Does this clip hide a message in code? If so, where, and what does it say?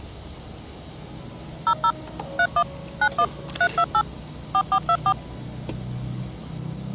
Yes: DTMF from 1.7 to 5.1 s, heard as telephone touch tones, dialled by machine, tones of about 70 ms, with the noise of a cafe. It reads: 00 31 91 328 4424